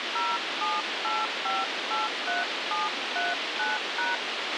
DTMF, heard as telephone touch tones, dialled by hand, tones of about 180 ms, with radio hiss and a squelch burst at the end. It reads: 078583739#